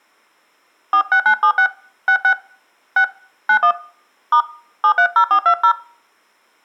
DTMF, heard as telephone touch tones, dialled by hand, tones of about 80 ms, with room echo. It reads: 46976 66 6 91 * 730420